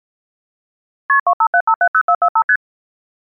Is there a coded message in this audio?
Yes: multi-frequency trunk signalling (R1, as on North American trunks) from 1.1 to 2.6 s, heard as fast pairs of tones, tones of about 70 ms. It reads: KP 257570445 ST